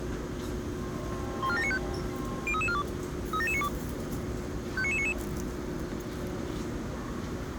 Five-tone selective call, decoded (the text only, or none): 14795 03342 37792 59999